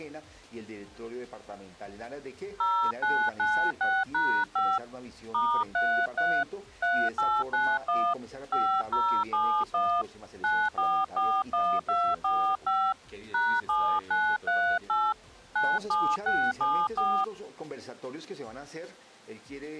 DTMF, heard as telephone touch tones, dialled by hand, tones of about 270 ms. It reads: 0996#5 *33 3891 5071 9441245 #7938 97674